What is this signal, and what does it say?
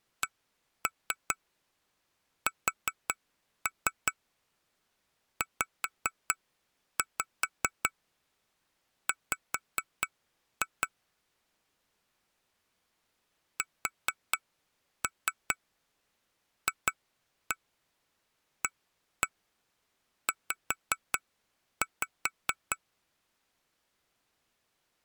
Tap code, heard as taps on glass, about 5 knocks a second. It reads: CSZW SFAZ